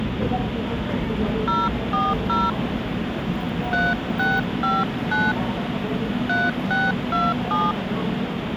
DTMF, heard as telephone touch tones, dialled by hand, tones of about 200 ms, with phone line noise and the noise of a subway station. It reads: 040 3659 3627